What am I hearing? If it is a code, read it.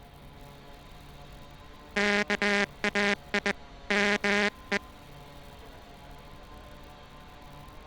Morse code (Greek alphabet), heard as a buzzer, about 20 wpm, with street noise. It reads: ΚΑΙ ΜΕ